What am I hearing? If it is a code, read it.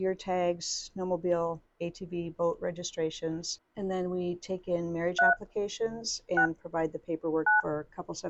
DTMF, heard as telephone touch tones, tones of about 130 ms. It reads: 3 6 9